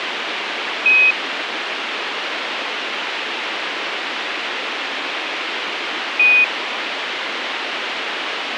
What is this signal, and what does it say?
Quindar tones, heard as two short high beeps, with radio hiss.